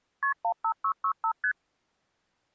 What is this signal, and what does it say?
Multi-frequency trunk signalling (R1, as on North American trunks), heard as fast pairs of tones, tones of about 80 ms. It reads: KP 15665 ST